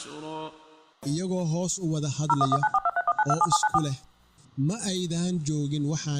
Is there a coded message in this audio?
Yes: DTMF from 2.3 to 3.8 s, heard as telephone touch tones, dialled by machine, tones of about 40 ms. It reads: 01194231927794